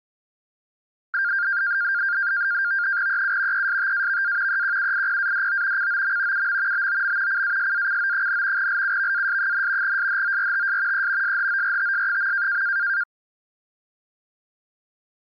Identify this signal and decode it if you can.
NAVTEX (SITOR-B), 100 baud, 170 Hz shift, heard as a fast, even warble, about 1500 Hz centre. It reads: EU ESTAVA EQUIPADO COM UM BOM CASACO, LUVAS, SHORTS E SHORTS.